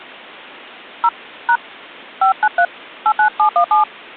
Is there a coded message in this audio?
Yes: DTMF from 1.0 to 3.8 s, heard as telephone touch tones, dialled by hand, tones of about 90 ms. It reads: 0 # 593 89717